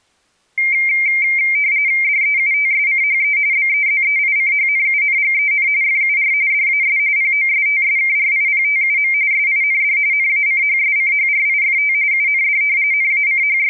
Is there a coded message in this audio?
Yes: RTTY (45.45 baud, 170 Hz shift) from 0.6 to 13.7 s, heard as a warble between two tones, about 2200 Hz centre. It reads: DEUTSCHE BEZEICHNUNGEN FUR DAS POSTSKRIPTUM SIND NACHSCHRIFT UND …